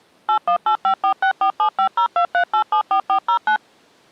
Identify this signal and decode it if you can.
DTMF, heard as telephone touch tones, dialled by machine, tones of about 90 ms. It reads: 818546475023874409